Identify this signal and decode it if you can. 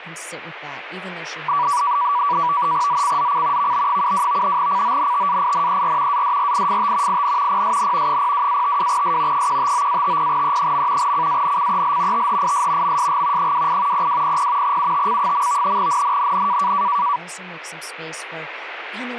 NAVTEX (SITOR-B), 100 baud, 170 Hz shift, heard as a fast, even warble, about 1060 Hz centre, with speech in English. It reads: ZCZC VB72 CONTAINER ADRIFT IN PSN 02-52S 159-50E. CANCEL THIS MSG 28 0200 UTC. NNNN